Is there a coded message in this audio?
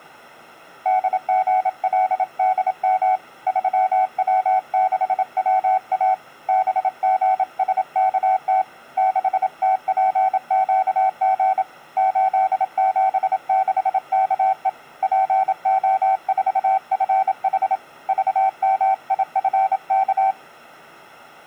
Yes: Morse code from 0.8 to 20.4 s, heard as a keyed tone, hand-sent with a paddle, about 27 wpm, 760 Hz. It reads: DGLDM 3W6WA BGSKT 6TPQG 876KE PO4FH VMIFK